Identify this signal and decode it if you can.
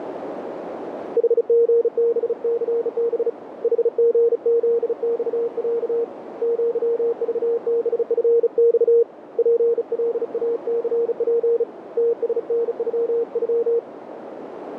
Morse code (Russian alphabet), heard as a keyed tone, hand-sent with a bug key, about 35 wpm, 470 Hz, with radio static and a narrow filter. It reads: ХГБЦБ ХГЗЬЯ ЪЖБФЬ ПЛАЦП ТСНЮЮ